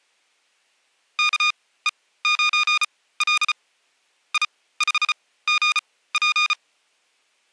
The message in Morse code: KE9L I5GP

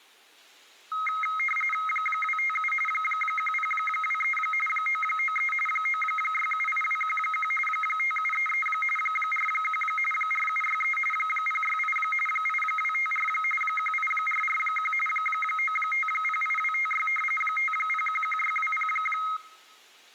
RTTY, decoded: 257 1023 993 9678211 5733 41 4763 068 8254 18441 9508256 5011620

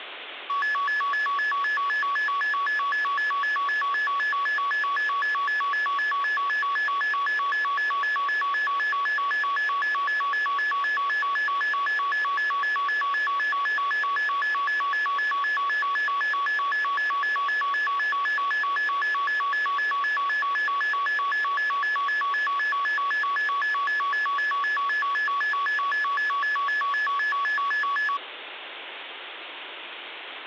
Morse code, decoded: none

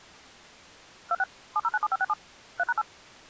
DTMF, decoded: 26 7097567 3#8

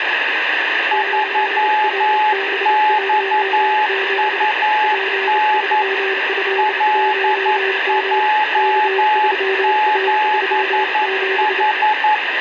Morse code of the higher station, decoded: 3XUN LJ7H

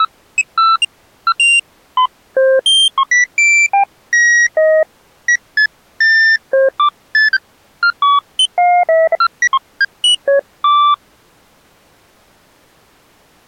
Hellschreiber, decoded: none

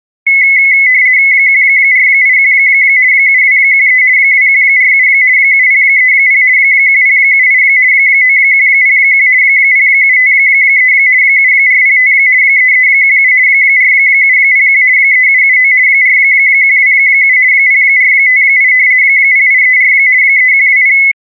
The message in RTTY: 1481 7213 2147 7030 1078 9101 0753 7405 3317 4701 3779 4127 0458 0834 3120

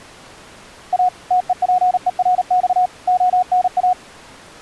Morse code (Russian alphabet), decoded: А ТЕПЕРЬ ОНА

